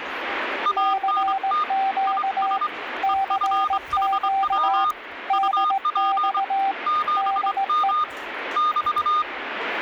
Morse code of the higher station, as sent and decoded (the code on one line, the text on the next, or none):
.- -. - / .. ... / . ..-. .... .-- / ..- .--. / --... -- / -...-
ANT IS EFHW UP 7M <BT>